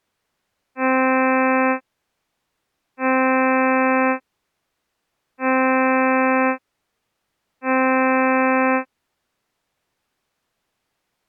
Ship horn signal, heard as a ship's horn, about 260 Hz. 4 short. At sea: a pilot vessel's identity signal in fog.